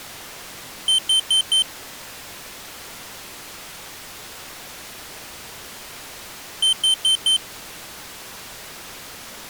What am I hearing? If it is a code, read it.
Alarm pattern, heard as an alarm's beeps, played twice, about 3100 Hz. Temporal four. Carbon monoxide.